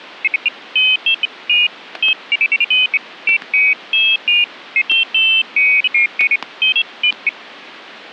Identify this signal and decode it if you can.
Pairs of high tones at irregular times, with static crashes. There is no code.